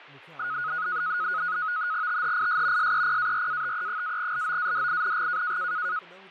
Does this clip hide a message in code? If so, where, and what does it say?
Yes: NAVTEX (SITOR-B), 100 baud, 170 Hz shift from 0.4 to 6.0 s, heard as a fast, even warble, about 1360 Hz centre, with fading and speech in Sindhi. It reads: THIS SEPARATE-LOADING